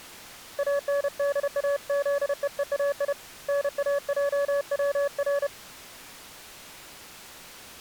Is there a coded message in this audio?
Yes: Morse code (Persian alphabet) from 0.5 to 5.5 s, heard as a keyed tone, hand-sent with a paddle, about 31 wpm, 570 Hz. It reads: اندازههای ناجور